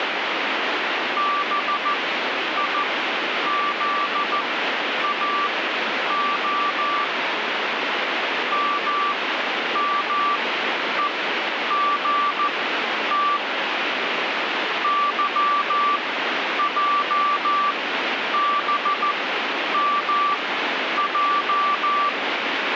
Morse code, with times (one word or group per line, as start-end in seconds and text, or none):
1.2-7.0 BIZAO
8.5-13.4 MMEGT
14.8-22.1 YJBMJ